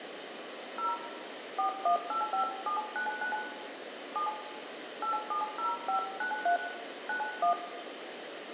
DTMF, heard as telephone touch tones, dialled by hand, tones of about 110 ms, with phone line noise and room echo. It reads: 0 4185799 7 870593 91